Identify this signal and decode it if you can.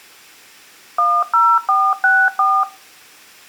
DTMF, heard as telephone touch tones, dialled by machine, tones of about 240 ms. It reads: 10464